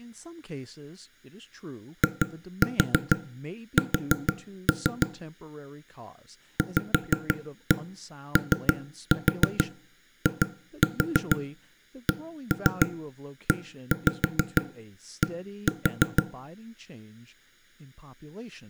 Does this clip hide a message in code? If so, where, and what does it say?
Yes: tap code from 2.0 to 16.2 s, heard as knocks on wood, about 6 knocks a second, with room echo and speech in English. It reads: IS VOICED